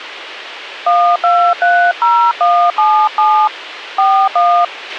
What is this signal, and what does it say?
DTMF, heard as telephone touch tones, dialled by hand, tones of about 300 ms, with radio hiss and a squelch burst at the end. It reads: 1230177 41